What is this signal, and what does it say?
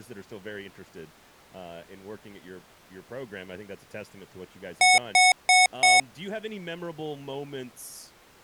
Beep code, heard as beeps from a small speaker, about 740 Hz, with speech in English. 4 short. In AMI BIOS tables: system timer failure; in Dell tables: memory read or write failure.